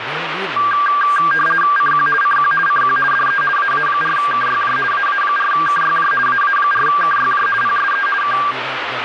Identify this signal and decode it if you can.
RTTY (50 baud, 450 Hz shift), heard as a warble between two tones, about 1390 Hz centre, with radio static and speech in Nepali. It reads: CQ CQ CQ DE AA4KYJ AA4KYJ AA4KYJ PSE K